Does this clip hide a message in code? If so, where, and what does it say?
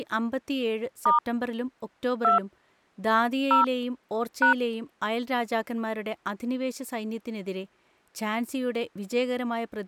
Yes: DTMF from 1.1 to 4.5 s, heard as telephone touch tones, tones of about 120 ms, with speech in Malayalam. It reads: * 2 0 #